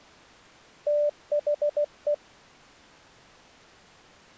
Morse code, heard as a keyed tone, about 16 wpm, 590 Hz. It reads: THE